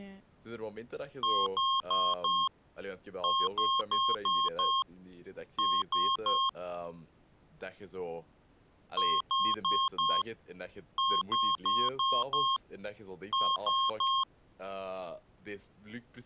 Beep code, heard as beeps from a small speaker, played twice, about 1070 Hz, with speech in Dutch. 4-5-3.